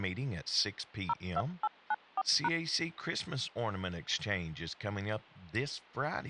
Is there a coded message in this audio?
Yes: DTMF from 1.1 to 2.5 s, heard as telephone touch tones, dialled by machine, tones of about 40 ms, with speech in English. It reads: 02894#